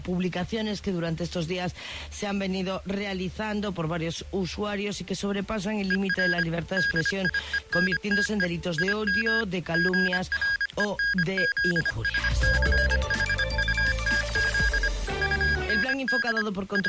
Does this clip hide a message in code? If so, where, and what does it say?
Yes: Morse code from 5.8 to 16.9 s, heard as electronic beeps, machine-sent, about 25 wpm, 1650 Hz. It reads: ER DIENTE IM GRENZSCHUTZ UND …